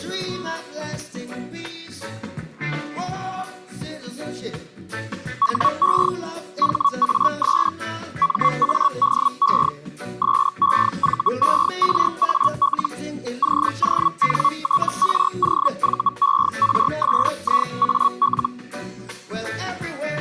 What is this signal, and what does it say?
Hellschreiber (Feld-Hell, 122.5 baud), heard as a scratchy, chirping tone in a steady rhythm, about 1120 Hz. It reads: HE HAS MADE SEVERAL CONTROVERSIAL